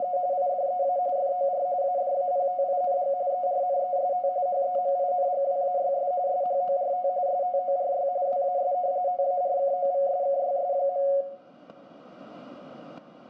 RTTY (45.45 baud, 170 Hz shift), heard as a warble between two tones, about 640 Hz centre, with static crashes and room echo. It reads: … IDEA FOR ADAPTING ERNEST HEMINGWAYS SHORT STORY WAS TARKOVSKYS.